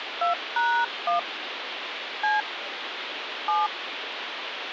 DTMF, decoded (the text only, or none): 2#1 C 7